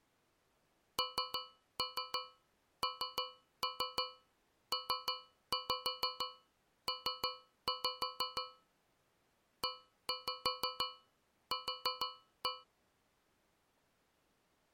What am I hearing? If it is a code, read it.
Tap code, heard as taps on a metal pipe, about 6 knocks a second. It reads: NNPP EQ